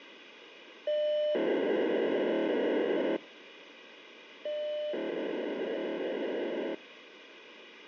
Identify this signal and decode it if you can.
POCSAG pager data (1200 baud), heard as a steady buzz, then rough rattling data, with radio hiss.